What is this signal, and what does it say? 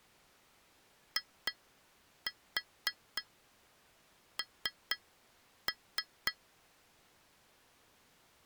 Tap code, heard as taps on glass, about 4 knocks a second. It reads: IN